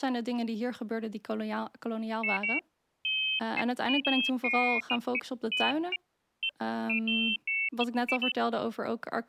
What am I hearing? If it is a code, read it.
Pairs of high tones at irregular times, with speech in Dutch. There is no code.